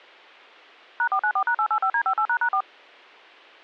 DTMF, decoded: #494#885D58##4

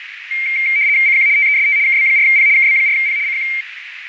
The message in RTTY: CQ TEST KB4P KB4P CQ

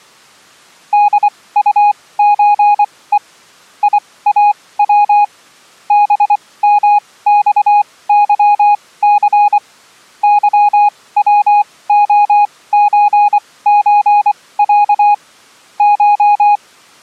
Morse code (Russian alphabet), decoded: ДУЧЕ ИАВ БМЬЫЦ ЫВОЧЧЯ Ш

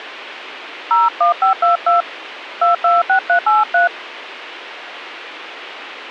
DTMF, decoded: 01522 226383

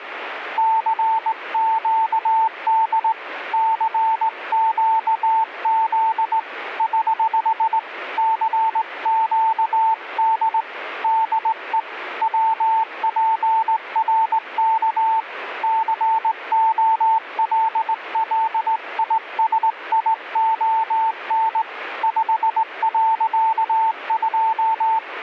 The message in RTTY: none

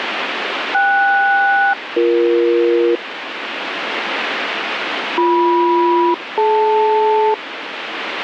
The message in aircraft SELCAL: KS-BE BM-DL

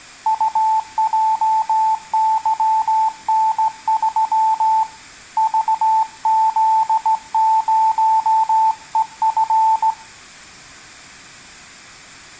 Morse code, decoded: UJYN3 VZ0EF

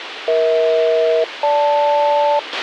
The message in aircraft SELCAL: EH-GL

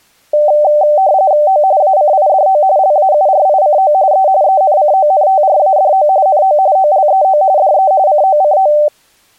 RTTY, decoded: O ACIDO LAURICO E ENCONTRADO NO OLEO DE COCO

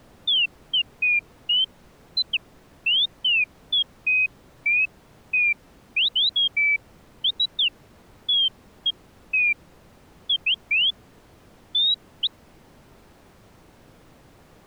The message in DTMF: none

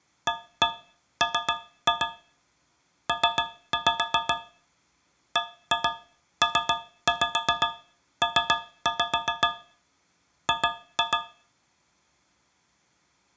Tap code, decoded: AM P BPP G

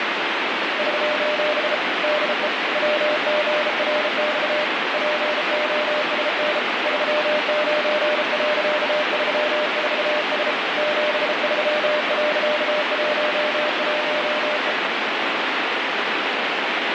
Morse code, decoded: <SOS> DE WGRX POSN 39.34S 73.11E

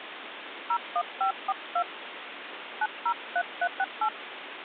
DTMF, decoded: 01542 903368

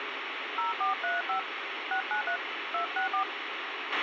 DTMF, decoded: 0435 693 264

